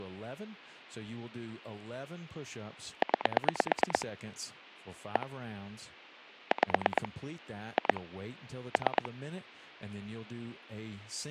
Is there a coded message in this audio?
Yes: pulse dialling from 3.0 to 9.1 s, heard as clicks on a phone line, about 9 pulses a second, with speech in English. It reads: 9 1 5 2 3